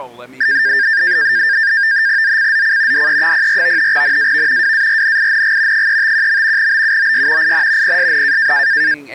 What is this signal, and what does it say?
NAVTEX (SITOR-B), 100 baud, 170 Hz shift, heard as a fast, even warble, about 1700 Hz centre, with speech in English. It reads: ZCZC DE04 NAV WARNING 351. BUOY IN PSN